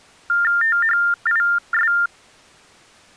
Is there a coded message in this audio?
Yes: TTY/TDD text telephone tones (45.45 baud Baudot) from 0.3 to 2.1 s, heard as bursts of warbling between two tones, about 400 Hz shift, 1600 Hz centre. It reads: THIS